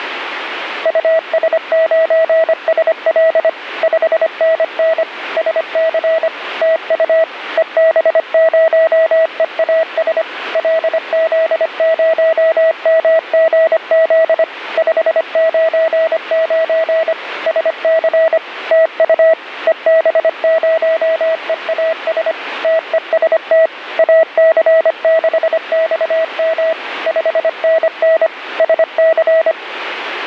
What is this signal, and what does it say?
Morse code, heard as a keyed tone, machine-sent, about 25 wpm, 650 Hz, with radio static. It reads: US9SL 5NN SC TU EB0EAS LZ0MGZ 599 SC TU EB0EAS TEST AC6XM 5NN SC